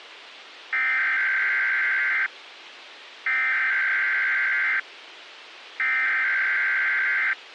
Emergency Alert System (SAME) tones (header bursts), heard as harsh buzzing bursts, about 520.83 baud, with radio hiss.